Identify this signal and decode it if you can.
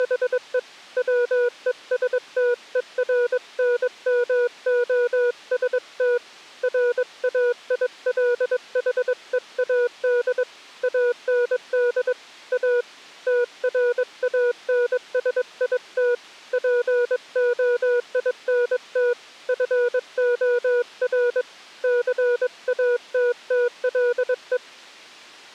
Morse code, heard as a keyed tone, hand-sent with a paddle, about 22 wpm, 480 Hz. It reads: … WESTERNMOST RAILHEAD AND A TRANSIT POINT FOR CATTLE